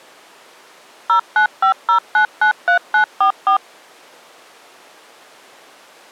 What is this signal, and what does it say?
DTMF, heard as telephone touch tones, dialled by machine, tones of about 100 ms. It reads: 0950993944